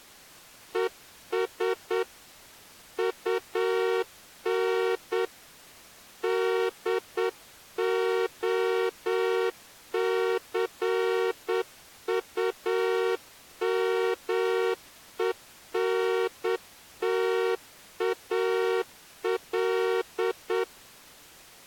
Morse code, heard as a horn, hand-sent with a straight key, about 8 wpm. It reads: ES UN DOCUMENTAL